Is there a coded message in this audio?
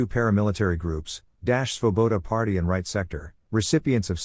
No, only speech in English.